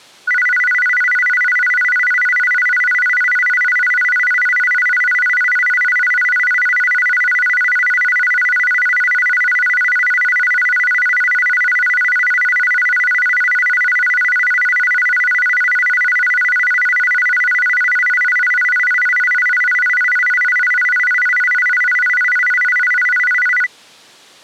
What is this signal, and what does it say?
A tone that alternates evenly between two pitches. There is no code.